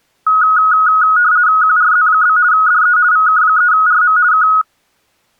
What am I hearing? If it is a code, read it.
RTTY (50 baud, 170 Hz shift), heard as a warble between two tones, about 1360 Hz centre. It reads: QRZ? DE VK3RM K